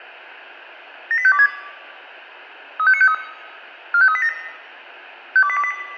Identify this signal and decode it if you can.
Five-tone selective call (ZVEI), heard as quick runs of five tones, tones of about 70 ms, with room echo. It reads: 78526 35953 45387 52828